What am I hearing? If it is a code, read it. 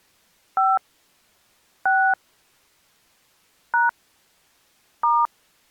DTMF, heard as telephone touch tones, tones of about 230 ms. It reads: 5 6 # *